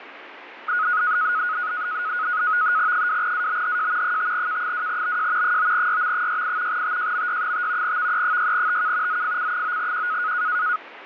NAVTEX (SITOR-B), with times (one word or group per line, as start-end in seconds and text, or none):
2.9-4.2 2ABHJ
4.0-5.6 5K2BJ
5.4-6.8 9YM68
6.7-8.0 TJMY5
7.8-9.2 VE6TK
9.1-10.3 ZFC9Q